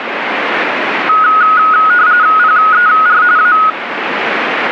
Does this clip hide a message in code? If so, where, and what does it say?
Yes: RTTY (45.45 baud, 170 Hz shift) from 1.1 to 3.7 s, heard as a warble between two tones, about 1360 Hz centre, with radio static. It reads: PER A